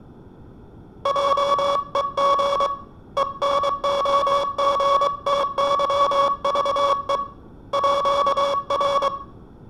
Morse code (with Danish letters), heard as a buzzer, hand-sent with a paddle, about 23 wpm. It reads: JEG ENOGTYVE ÅR